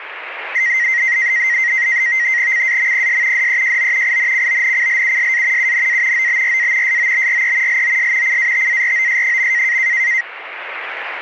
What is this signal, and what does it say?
NAVTEX (SITOR-B), 100 baud, 170 Hz shift, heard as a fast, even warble, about 2000 Hz centre, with radio static. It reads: CAMPS DEJO INCONCLUSA UNA OBRA SOBRE LOS CATAROS.